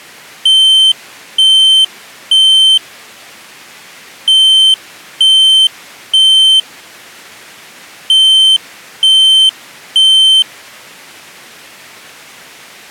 Alarm pattern, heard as an alarm's beeps, played three times, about 3100 Hz. Temporal three. Smoke or fire, evacuate.